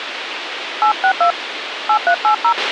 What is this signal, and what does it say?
DTMF, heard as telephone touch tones, dialled by hand, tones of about 80 ms, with radio hiss and a squelch burst at the end. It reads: 862 8380